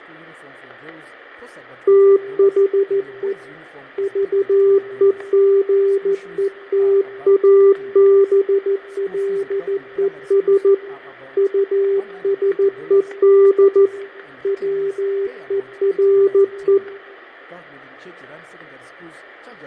Morse code, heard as a keyed tone, hand-sent with a paddle, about 14 wpm, 390 Hz, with fading, static crashes and room echo. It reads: THE VEGETABLES USED WERE